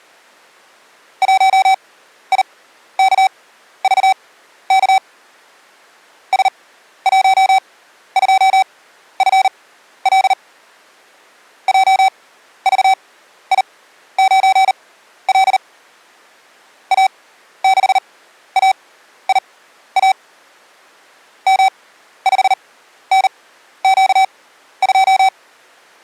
Morse code, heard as electronic beeps, machine-sent, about 39 wpm, spaced as for 13 wpm, 770 Hz. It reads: 1IKVK S12FL JVI9L A6AIA M5NQ2